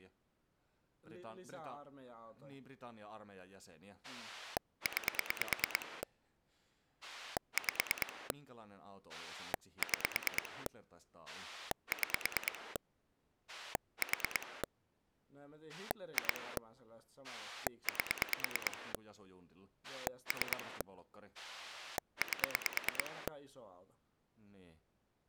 Pulse dialling, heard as a rotary dial, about 9 pulses a second, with speech in Finnish. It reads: 9 5 6 6 4 2 8 3 8